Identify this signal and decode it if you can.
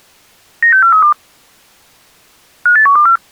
Five-tone selective call (CCIR), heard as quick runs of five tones, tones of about 100 ms. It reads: 96432 58124